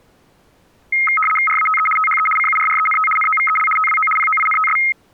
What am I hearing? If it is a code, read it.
RTTY (75 baud, 850 Hz shift), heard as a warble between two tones, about 1700 Hz centre. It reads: RATE THE CURRENT NOVEL TWO POINTS